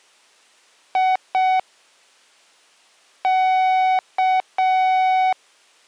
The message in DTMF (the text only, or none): none